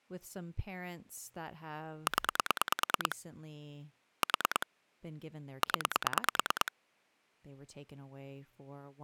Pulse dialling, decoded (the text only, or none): 0 4 0